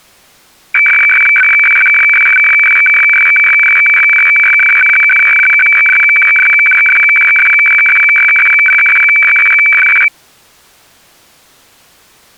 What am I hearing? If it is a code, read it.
Weather fax (radiofax), 120 lines a minute, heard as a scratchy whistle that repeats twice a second.